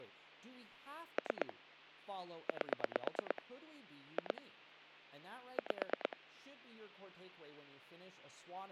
Pulse dialling, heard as clicks on a phone line, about 9 pulses a second, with hum and speech in English. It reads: 3 8 2 5